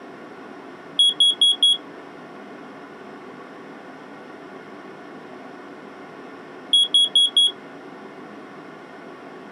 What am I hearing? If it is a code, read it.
Alarm pattern, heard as an alarm's beeps, played twice, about 3350 Hz. Temporal four. Carbon monoxide.